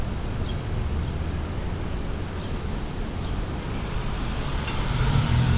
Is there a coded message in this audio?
No, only street noise.